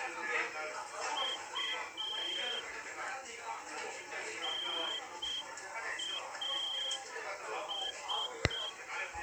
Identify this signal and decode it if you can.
Morse code (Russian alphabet), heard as a whistle, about 6 wpm, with room echo and the noise of a restaurant. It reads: У НАС